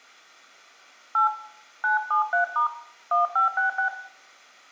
DTMF, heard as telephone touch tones, dialled by hand, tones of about 120 ms, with room echo. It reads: 8 973* 1566